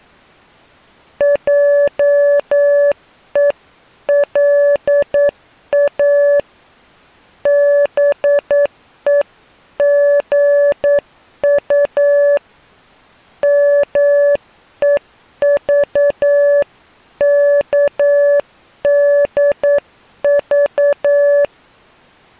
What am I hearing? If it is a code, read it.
Morse code (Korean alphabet), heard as a keyed tone, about 9 wpm, 570 Hz. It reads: 하고 다시 말을